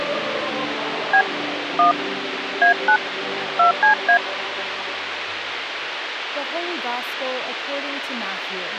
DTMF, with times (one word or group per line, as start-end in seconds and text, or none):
1.1-1.2 B
1.8-1.9 1
2.6-3.0 A9
3.6-4.2 2CA